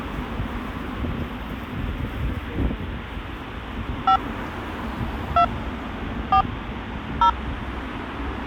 DTMF, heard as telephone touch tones, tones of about 90 ms, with street noise. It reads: 5 2 4 0